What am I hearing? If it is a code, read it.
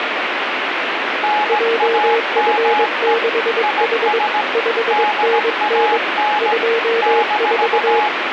Morse code, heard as two keyed tones, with radio static. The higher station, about 17 wpm, 840 Hz: NAME IS DAN -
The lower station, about 22 wpm, 460 Hz: JF6H 5NN 24